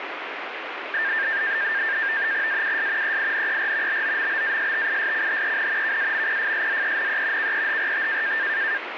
NAVTEX (SITOR-B), 100 baud, 170 Hz shift, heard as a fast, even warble, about 1700 Hz centre, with radio static. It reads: AUS EINER BOMBASTISCHEN KAMPFSZENE KEHRT